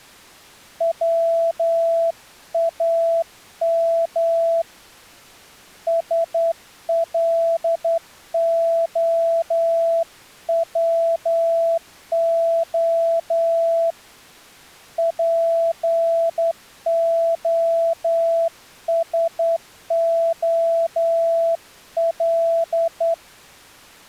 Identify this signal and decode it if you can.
Morse code (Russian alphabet), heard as a keyed tone, hand-sent with a straight key, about 10 wpm, 670 Hz. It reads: ВАМ СЛОВО ПОСОЛ